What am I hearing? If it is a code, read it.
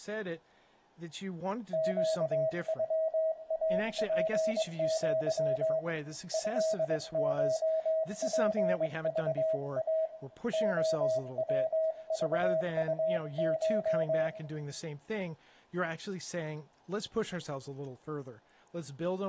Morse code (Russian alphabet), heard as a keyed tone, hand-sent with a paddle, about 22 wpm, 640 Hz, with room echo and speech in English. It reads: ЩЮАПЪ ЭШПЖА ОВЖУШ